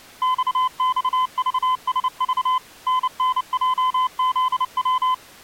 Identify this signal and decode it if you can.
Morse code, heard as a keyed tone, machine-sent, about 29 wpm, 1020 Hz. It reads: XXVSV NNJZW